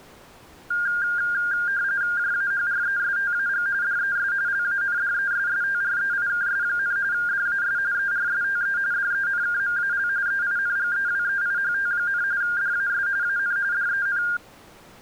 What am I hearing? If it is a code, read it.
RTTY (45.45 baud, 170 Hz shift), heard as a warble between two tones, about 1500 Hz centre. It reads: JAHRESTAG DES LANDESSTREIKS, DAS ERSTE DENKMAL EINGEWEIHT, DAS AN DEN